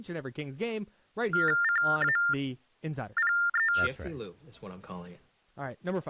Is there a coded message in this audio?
Yes: TTY/TDD text telephone tones (45.45 baud Baudot) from 1.3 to 3.9 s, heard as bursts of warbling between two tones, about 400 Hz shift, 1600 Hz centre, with speech in English. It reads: CAPE